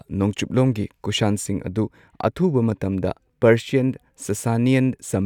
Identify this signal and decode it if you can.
Speech in Manipuri. There is no code.